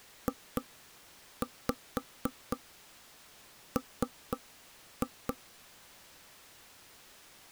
Tap code, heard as knocks on wood, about 4 knocks a second. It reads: JM